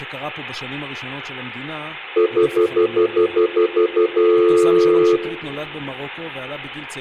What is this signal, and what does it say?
Telephone call progress tone (North American plan), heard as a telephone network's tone, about 350, 440 Hz, 0.1 s on and 0.1 s off, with room echo and speech in Hebrew. Stutter dial tone.